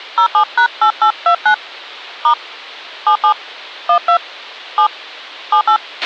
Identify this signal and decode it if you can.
DTMF, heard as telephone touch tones, dialled by hand, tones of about 90 ms, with a squelch burst at the end. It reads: 07#8829 * 77 12 7 78